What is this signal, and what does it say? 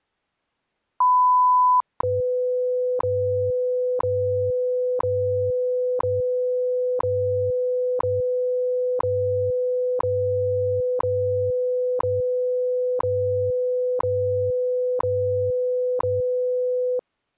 Radio time signal (WWV, Colorado), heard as ticks, one a second.